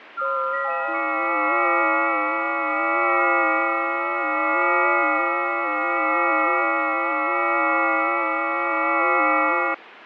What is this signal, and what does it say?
FT8 (several signals at once), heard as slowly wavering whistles, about 6.25 baud, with radio static.